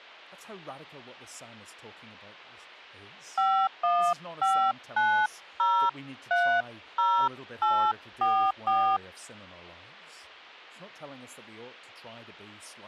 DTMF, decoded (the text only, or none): 5159030844